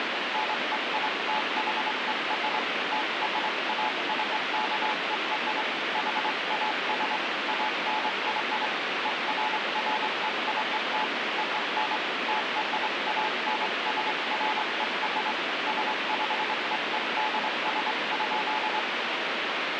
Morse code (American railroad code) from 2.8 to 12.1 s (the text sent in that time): TRACKER HAS ANY EFFECT ON